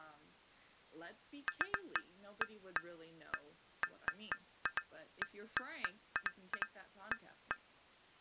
Irregular taps on glass, with speech in English. There is no code.